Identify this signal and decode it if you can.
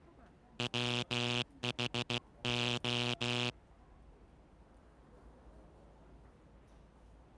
Morse code, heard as a buzzer, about 16 wpm, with the noise of a subway station. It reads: WHO